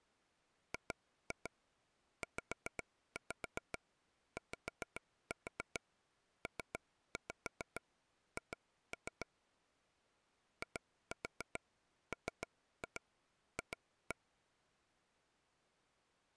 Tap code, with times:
0.7-9.3 GZYPH
10.6-14.2 IMF

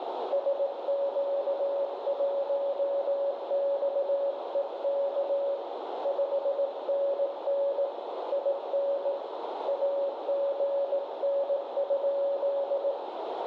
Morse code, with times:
0.3-5.6 SQ1XEK
6.0-7.8 5NN
8.3-9.1 IN
9.7-12.9 AGN?

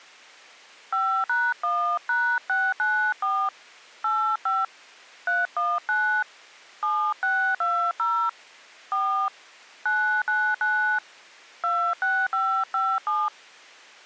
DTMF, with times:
0.9-3.5 5#1#694
4.0-4.6 85
5.3-6.2 319
6.8-8.3 7620
8.9-9.3 4
9.9-11.0 999
11.6-13.3 26557

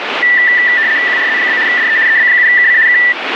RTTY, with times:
1.1-1.6 QRZ?
1.7-2.0 DE
2.1-2.8 EB7KC
2.9-3.0 K

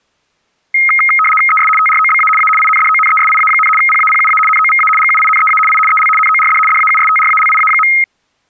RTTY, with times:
1.5-1.7 ES
1.8-2.3 TROBA
2.4-2.5 A
2.6-3.7 INDONESIA,
3.8-4.4 PAPUA
4.5-4.9 NOVA
5.0-5.6 GUINEA
5.7-5.8 I
5.9-6.1 EL
6.2-6.6 NORD
6.7-7.9 DAUSTRALIA.

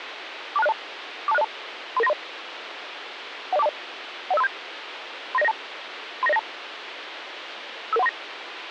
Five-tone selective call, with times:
0.6-0.7 42602
1.3-1.4 42602
2.0-2.1 33930
3.5-3.7 10420
4.3-4.5 10537
5.3-5.5 39092
6.2-6.4 39092
7.9-8.1 55139

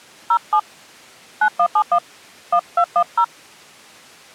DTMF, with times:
0.3-0.6 07
1.4-2.0 9171
2.5-3.2 1210

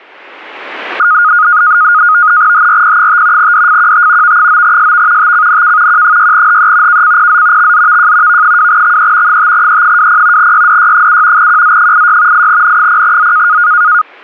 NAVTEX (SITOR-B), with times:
2.5-3.5 HRP5
3.4-4.4 DFQT
4.2-5.3 V9SV
5.2-6.0 TCNK
5.9-7.0 Q6HE
6.9-7.7 KCPZ
7.6-8.4 XZVJ
8.3-9.4 V2XE
9.3-10.5 5E20
10.4-11.5 YDY7
11.4-12.5 QZ86
12.3-13.6 8N0Z

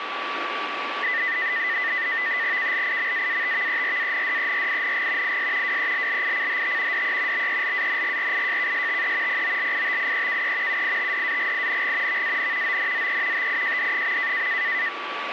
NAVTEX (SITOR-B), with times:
2.6-5.4 KLIMAATVERANDERING
5.2-5.8 IS
5.6-7.0 WELLICHT
6.9-7.5 DE
7.3-9.4 BELANGRIJKSTE
9.3-10.8 POLITIEKE
10.7-12.2 UITDAGING
12.1-12.8 VAN
12.6-13.5 ONZE
13.3-14.5 TIJD.

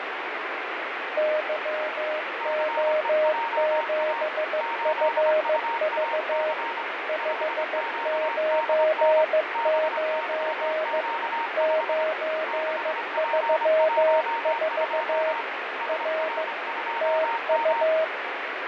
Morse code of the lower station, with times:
1.2-6.5 YO7FV
7.1-11.0 599
11.6-15.3 934
15.9-16.4 R
17.0-18.0 TU

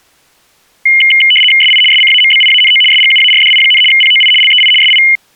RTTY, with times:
1.6-1.8 SI
1.9-2.8 SCAMBIANO
2.9-3.8 SGUARDI,
3.9-4.3 POI
4.4-4.7 LEI
4.8-5.0 SI

